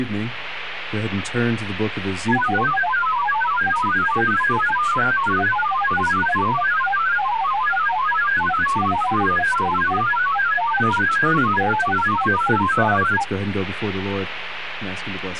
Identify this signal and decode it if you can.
Multi-tone FSK (Olivia or MFSK type), about 1000 Hz wide, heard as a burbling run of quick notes, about 31.25 baud, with radio static.